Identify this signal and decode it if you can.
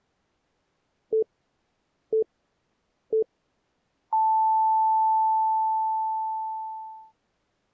Radio time signal (three low pips and a long one an octave up, as on NHK), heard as pips.